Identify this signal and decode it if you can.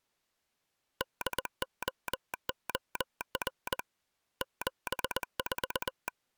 Morse code, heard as a telegraph sounder, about 20 wpm. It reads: DOOR 74